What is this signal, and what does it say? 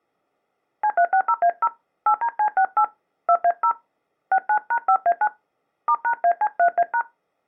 DTMF, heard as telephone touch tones, dialled by hand, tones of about 70 ms. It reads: C360A0 8DC68 2A0 69#5A9 *#AC3A#